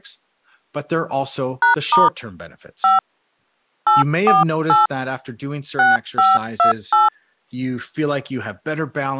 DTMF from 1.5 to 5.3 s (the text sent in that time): #* 5 848